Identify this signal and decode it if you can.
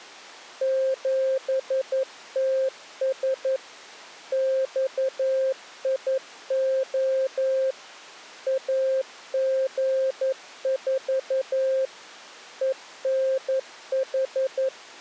Morse code, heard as a keyed tone, machine-sent, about 11 wpm, 530 Hz. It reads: 7TS XIO AG4 ENH